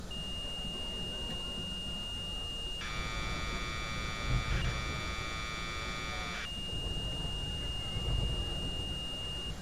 Commodore tape loading (standard loader), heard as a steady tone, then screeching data, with street noise.